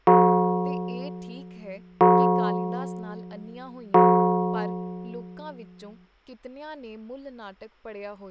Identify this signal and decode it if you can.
Clock strike, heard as a bell, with speech in Punjabi. 3. Three o'clock.